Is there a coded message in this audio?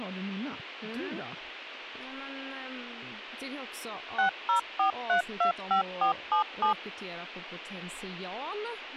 Yes: DTMF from 4.2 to 6.7 s, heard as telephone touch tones, dialled by machine, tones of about 110 ms, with speech in Swedish. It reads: 604325477